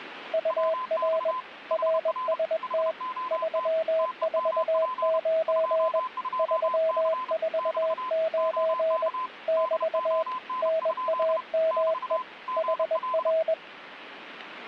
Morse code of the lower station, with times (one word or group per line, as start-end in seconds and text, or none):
0.3-1.3 UR
1.7-2.9 RST
3.3-6.0 349
6.4-9.1 349
9.5-10.2 <BT>
10.6-12.2 NAME
12.6-13.5 HR